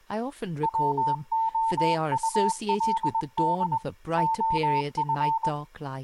Morse code, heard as a keyed tone, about 21 wpm, 900 Hz, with speech in English. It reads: WOULD OF